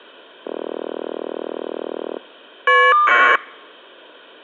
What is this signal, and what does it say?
Caller ID data burst, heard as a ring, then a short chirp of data, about 1200 baud.